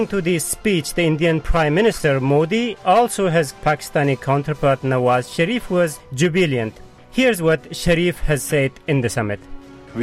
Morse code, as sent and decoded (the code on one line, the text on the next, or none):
none